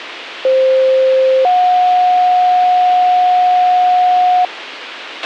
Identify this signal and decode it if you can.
Two-tone page, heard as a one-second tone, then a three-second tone, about 520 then 730 Hz, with radio hiss and a squelch burst at the end.